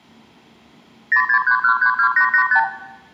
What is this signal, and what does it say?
Multi-frequency trunk signalling (R2, with the far end's replies), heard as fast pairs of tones, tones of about 90 ms, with room echo. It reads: 063132885